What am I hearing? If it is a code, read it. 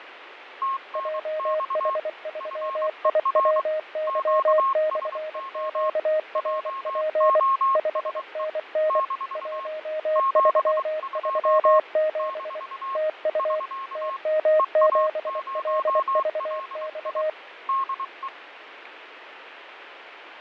Morse code, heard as two keyed tones, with radio static and fading. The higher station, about 23 wpm, 1080 Hz: TNX FER QSO JOSE - 72 - <SK> EA0LI DE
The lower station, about 24 wpm, 620 Hz: JH3IWY/QRP 5NN 1337 TU TM7LVX